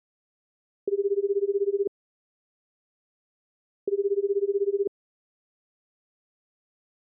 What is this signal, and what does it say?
Telephone call progress tone (Japanese plan), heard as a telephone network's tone, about 380, 400, 420 Hz, 1 s on and 2 s off. Ringback tone.